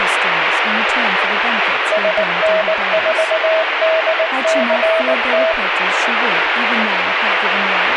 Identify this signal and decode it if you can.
Morse code, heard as a keyed tone, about 19 wpm, 640 Hz, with radio static and speech in English. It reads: SN4DCT